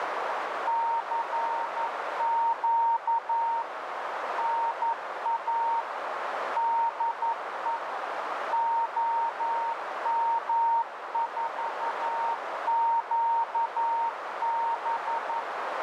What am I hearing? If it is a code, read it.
Morse code, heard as a keyed tone, machine-sent, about 11 wpm, 920 Hz, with heavy radio static and a narrow filter. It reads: CQ NA DE OM4QB